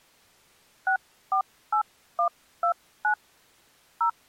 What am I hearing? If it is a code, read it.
DTMF, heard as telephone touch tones, dialled by hand, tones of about 90 ms. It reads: 648129 0